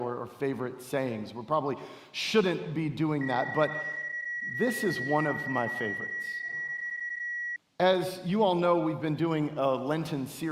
PSK31 (31.25 baud), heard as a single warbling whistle, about 1900 Hz.